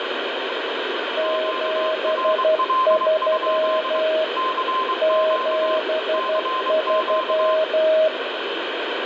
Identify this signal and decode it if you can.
Morse code, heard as two keyed tones, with heavy radio static. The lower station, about 12 wpm, 630 Hz: 73 73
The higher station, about 23 wpm, 1040 Hz: QRL? CQ CQ